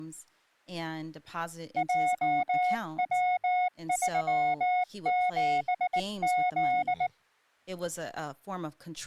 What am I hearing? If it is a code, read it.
Morse code, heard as a keyed tone, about 19 wpm, 730 Hz, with speech in English. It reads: JW37Z